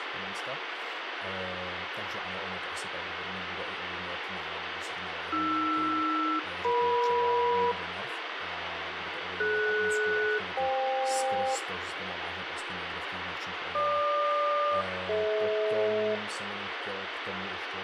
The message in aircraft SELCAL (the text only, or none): AR-EM DS-FK GQ-DH